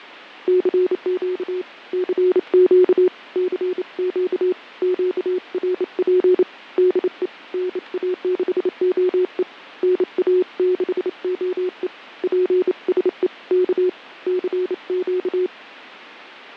Morse code, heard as a keyed tone, hand-sent with a bug key, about 28 wpm, 370 Hz, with fading. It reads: CQ CQ CQ QRP DE NA6OE NA6OE PSE K CQ